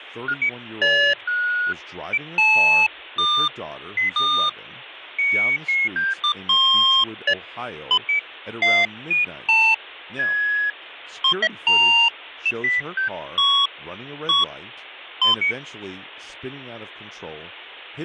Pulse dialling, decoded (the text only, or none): none